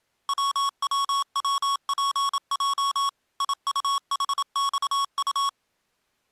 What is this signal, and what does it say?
Morse code, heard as electronic beeps, machine-sent, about 27 wpm, 1110 Hz. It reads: WWWPJ IUHXU